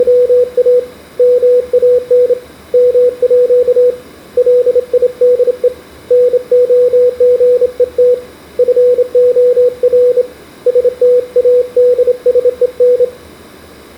Morse code (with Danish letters), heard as a keyed tone, hand-sent with a straight key, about 28 wpm, 490 Hz, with room echo. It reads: … MAN MÅ LIDE NOGET FOR STADSEN